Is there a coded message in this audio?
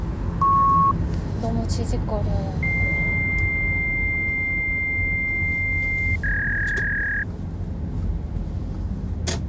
Yes: fax machine handshake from 0.4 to 7.2 s, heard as a beep, a long tone and a warble, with the noise inside a car.